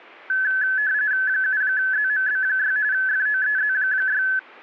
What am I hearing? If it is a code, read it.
RTTY (45.45 baud, 170 Hz shift), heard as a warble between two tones, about 1600 Hz centre. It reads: 7ZMB6 FOEZ6